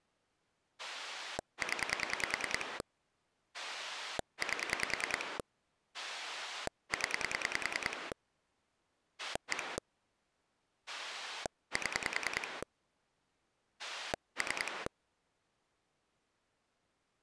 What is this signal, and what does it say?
Pulse dialling, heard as a rotary dial, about 10 pulses a second. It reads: 0 8 0 1 7 3